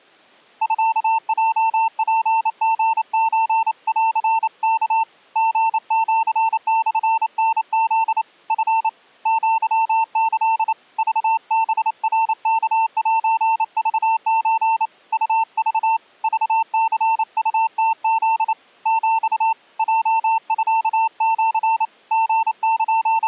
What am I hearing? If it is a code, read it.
Morse code (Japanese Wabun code), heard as a keyed tone, hand-sent with a bug key, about 28 wpm, 900 Hz. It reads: ミヲツリソンワ リシモタフ チ アキ クハナワセクソ ウク クニウムフ ヒ ヲミシ …